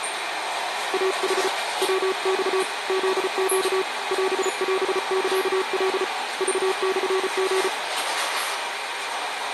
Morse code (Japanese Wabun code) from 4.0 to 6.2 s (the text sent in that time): オオサカ